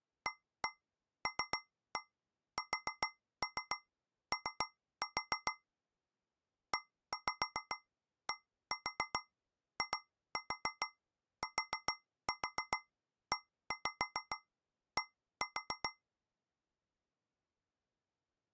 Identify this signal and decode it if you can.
Tap code, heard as taps on a metal pipe, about 7 knocks a second. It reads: ALSO EDITED